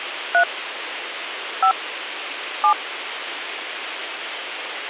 DTMF, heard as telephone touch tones, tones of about 90 ms, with radio hiss. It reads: 3 5 7